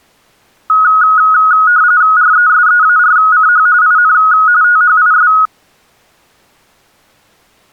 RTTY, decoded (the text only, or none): RESEARCH IN THIS